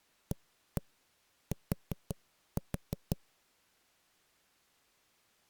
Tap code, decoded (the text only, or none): AT